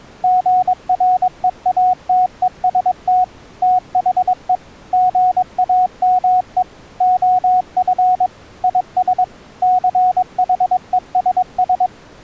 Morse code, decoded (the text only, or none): GREATEST THE GAME OF IS CHESS